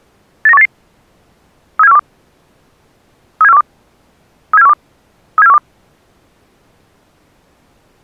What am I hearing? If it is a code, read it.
Five-tone selective call (EEA), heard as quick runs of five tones, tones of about 40 ms. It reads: 89188 37412 37412 37412 37412